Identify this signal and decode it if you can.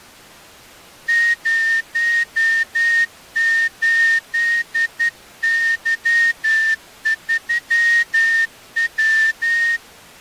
Morse code, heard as a whistle, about 11 wpm. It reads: 08Y3W